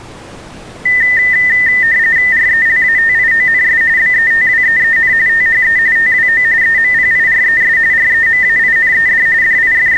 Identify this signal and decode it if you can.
RTTY (45.45 baud, 170 Hz shift), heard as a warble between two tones, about 1900 Hz centre. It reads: RELATIONS BETWEEN THE TWO EMPIRES REMAINED …